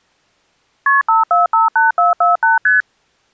Multi-frequency trunk signalling (R1, as on North American trunks), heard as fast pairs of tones, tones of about 150 ms. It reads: KP 5458448 ST